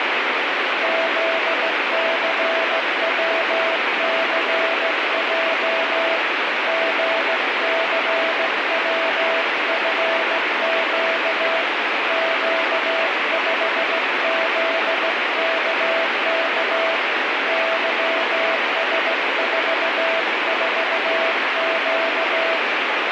Morse code, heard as a keyed tone, hand-sent with a straight key, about 16 wpm, 660 Hz, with heavy radio static. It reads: ZCWCJ GCWFQ Q5ZKK YS44Q